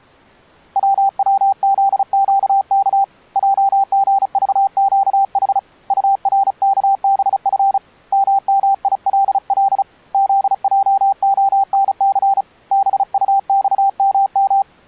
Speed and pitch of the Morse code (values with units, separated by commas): 35 wpm, 790 Hz